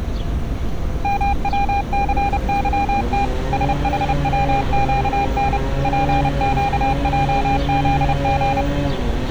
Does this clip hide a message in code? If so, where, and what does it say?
Yes: Morse code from 1.0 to 8.7 s, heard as a keyed tone, machine-sent, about 30 wpm, 800 Hz, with street noise. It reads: MWCYT SHWQN PQJZG